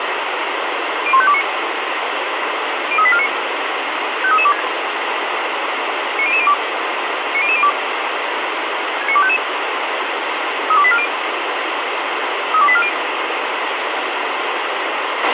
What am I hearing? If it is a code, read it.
Five-tone selective call (ZVEI), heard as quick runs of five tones, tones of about 70 ms, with radio hiss and a squelch burst at the end. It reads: 01529 03849 53326 90002 90002 69255 32840 32840